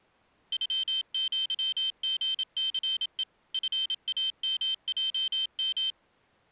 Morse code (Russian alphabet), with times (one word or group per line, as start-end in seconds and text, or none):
0.5-3.2 ЮЪГЦЕ
3.5-5.9 ФАМЙМ